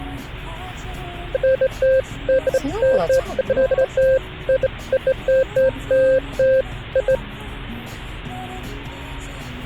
Beeps of irregular length, with the noise inside a car. There is no code.